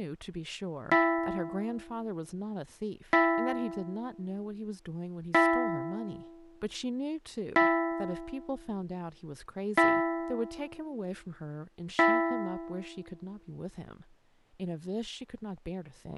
Clock strike, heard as a bell, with speech in English. 6. Six o'clock.